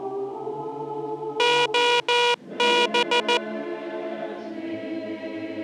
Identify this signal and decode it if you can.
Morse code (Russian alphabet), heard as a buzzer, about 14 wpm. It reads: ОБ